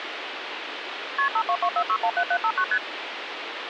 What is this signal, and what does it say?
Multi-frequency trunk signalling (R1, as on North American trunks), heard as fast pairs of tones, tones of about 70 ms, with phone line noise. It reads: KP 5224617759 ST